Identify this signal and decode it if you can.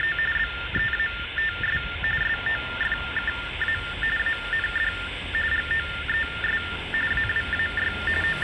TTY/TDD text telephone tones (45.45 baud Baudot), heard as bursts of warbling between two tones, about 400 Hz shift, 1600 Hz centre, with phone line noise and street noise. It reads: … BEATS SOFKA AND GOES AWAY …